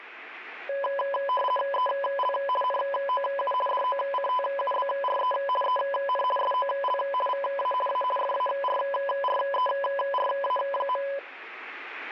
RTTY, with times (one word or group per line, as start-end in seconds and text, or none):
1.7-2.3 EL
2.6-3.5 NOU
3.7-5.3 DOCTUBRE
5.6-6.2 EN
6.4-7.0 SOL
7.3-7.7 VA
7.9-8.0 A
8.2-11.0 FARRERA.